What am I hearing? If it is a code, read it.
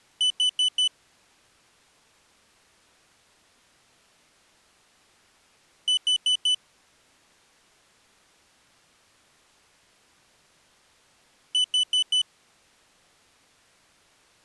Alarm pattern, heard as an alarm's beeps, played three times, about 3000 Hz. Temporal four. Carbon monoxide.